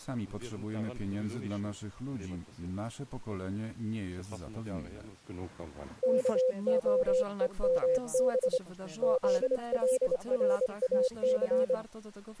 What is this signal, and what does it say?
Morse code, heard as a keyed tone, hand-sent with a straight key, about 25 wpm, 510 Hz. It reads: KOEMB ZLRAC